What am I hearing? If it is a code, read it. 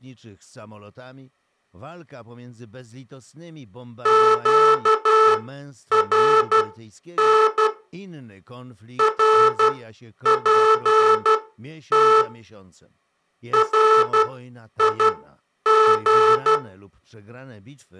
Morse code, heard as a buzzer, machine-sent, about 12 wpm, spaced as for 9 wpm. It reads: QRN RPT RIG